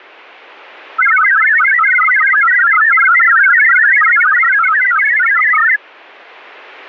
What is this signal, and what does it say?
Multi-tone FSK (Olivia or MFSK type), about 1000 Hz wide, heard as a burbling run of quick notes, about 62.5 baud.